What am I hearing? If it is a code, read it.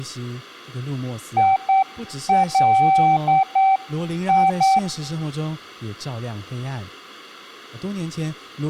Morse code, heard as a keyed tone, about 8 wpm, 770 Hz, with speech in English. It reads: ILI